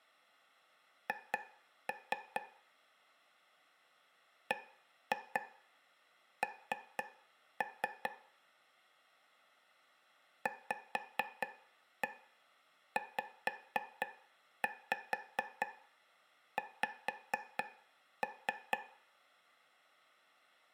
Tap code, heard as taps on a table, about 4 knocks a second, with room echo. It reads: H BN VZX